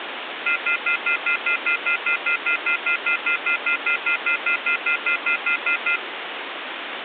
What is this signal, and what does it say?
Telephone call progress tone (North American plan), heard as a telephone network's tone, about 1400, 2050, 2450, 2600 Hz, 0.1 s on and 0.1 s off, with phone line noise. Off-hook warning tone.